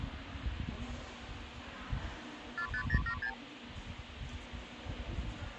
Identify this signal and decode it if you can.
Multi-frequency trunk signalling (R2, with the far end's replies), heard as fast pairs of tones, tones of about 80 ms, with phone line noise and the noise of a subway station. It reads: 45076